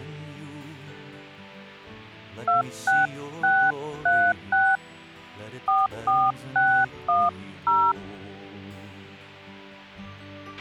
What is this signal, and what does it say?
DTMF, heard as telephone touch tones, dialled by hand, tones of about 250 ms, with a squelch burst at the end. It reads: 26636 44610